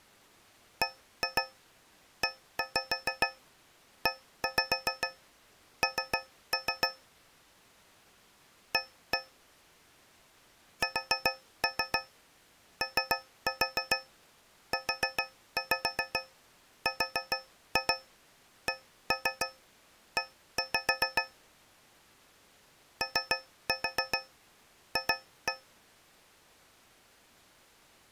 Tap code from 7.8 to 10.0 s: A

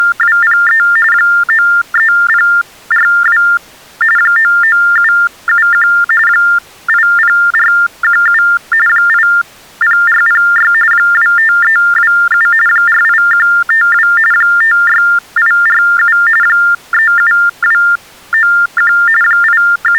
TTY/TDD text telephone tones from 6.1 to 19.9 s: 80417 80406 25327 48152 56847 37291 …

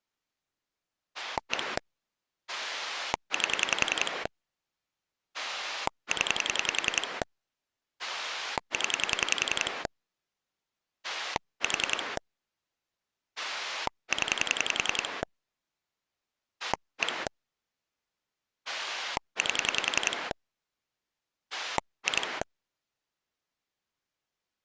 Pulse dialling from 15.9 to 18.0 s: 1

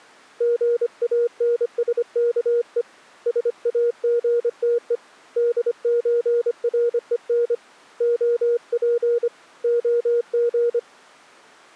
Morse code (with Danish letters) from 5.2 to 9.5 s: DØREN OP

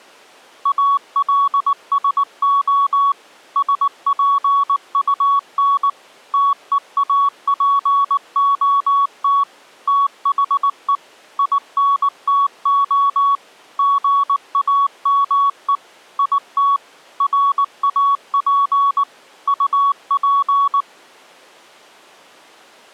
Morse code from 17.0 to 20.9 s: RAP UP

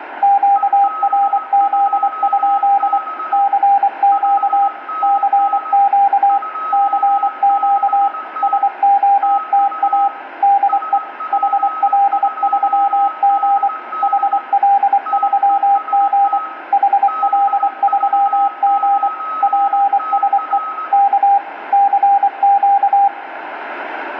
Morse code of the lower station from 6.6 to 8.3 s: CQ

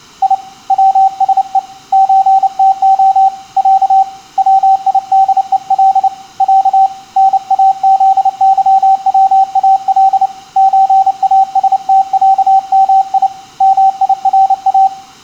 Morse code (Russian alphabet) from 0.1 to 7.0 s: И ВСЕ ЧТО Я ВИДЕЛ Я

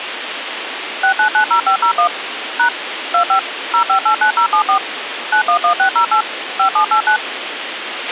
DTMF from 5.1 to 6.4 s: 911608

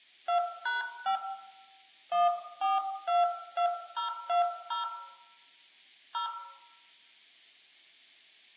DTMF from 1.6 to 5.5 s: 1422020

